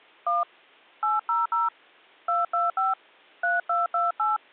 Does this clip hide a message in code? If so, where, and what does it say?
Yes: DTMF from 0.3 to 4.4 s, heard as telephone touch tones, dialled by hand, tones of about 170 ms. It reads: 1 800 225 3228